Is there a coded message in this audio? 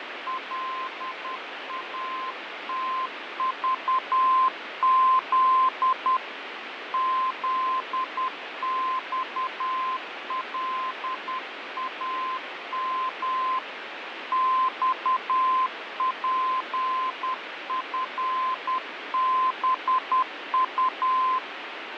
Yes: Morse code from 0.2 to 21.4 s, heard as a keyed tone, hand-sent with a paddle, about 10 wpm, 1040 Hz, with radio static and fading. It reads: LATVZ ZXLAM XPFBU